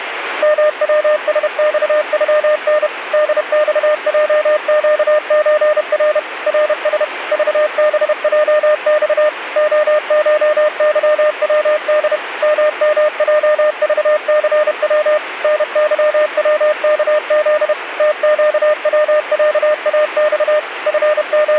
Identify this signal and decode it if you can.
Morse code (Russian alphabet), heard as a keyed tone, machine-sent, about 31 wpm, 610 Hz, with radio static. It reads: МВСЬЮН ДЬЙЩЧР РС ЖБЙЬ ОШЫВД ММЙЖЦВ НЫВКЗ ТЩВЯАЬ …